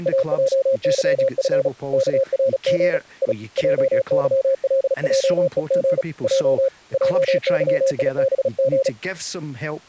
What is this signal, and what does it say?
Morse code, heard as a keyed tone, hand-sent with a paddle, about 36 wpm, 540 Hz, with speech in English. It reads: AJYF KRG I JYLJEG J JYIBG